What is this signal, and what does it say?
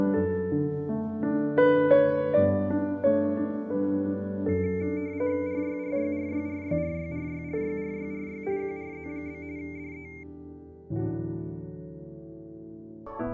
RTTY (45.45 baud, 170 Hz shift), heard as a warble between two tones, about 2200 Hz centre. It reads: RYRYRYRYRYRYRYRYRY QRZ? DE